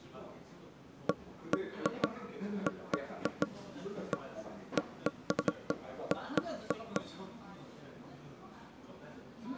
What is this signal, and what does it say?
Irregular knocks on wood, with the noise of a crowd indoors. There is no code.